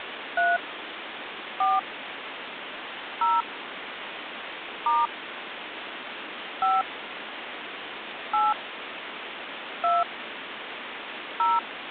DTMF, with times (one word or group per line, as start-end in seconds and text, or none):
0.4-0.6 3
1.6-1.8 4
3.2-3.4 0
4.9-5.1 *
6.6-6.8 5
8.3-8.5 8
9.8-10.0 2
11.4-11.6 0